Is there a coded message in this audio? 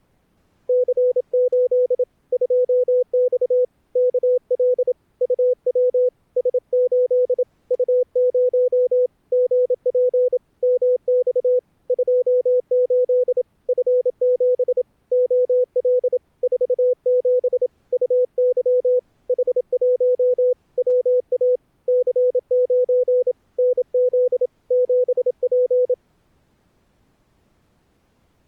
Yes: Morse code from 0.6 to 26.0 s, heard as a keyed tone, hand-sent with a paddle, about 27 wpm, 500 Hz. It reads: C8 2X KL UW S8 U0 GP MX 28 F7 OL 47 UY H1 WA C9 NZ 7P